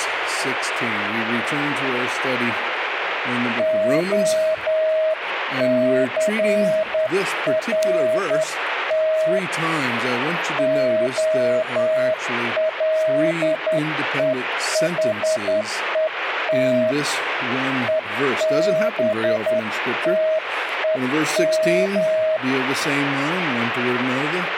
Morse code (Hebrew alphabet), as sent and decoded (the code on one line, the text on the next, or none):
--- -.-. .-. - / --- .-.. . .... . - / . -... - . --
הסרת הלוחות ובתום